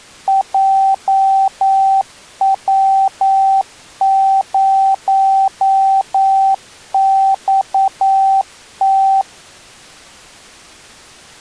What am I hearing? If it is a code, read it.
Morse code, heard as a keyed tone, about 9 wpm, 780 Hz. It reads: JW0XT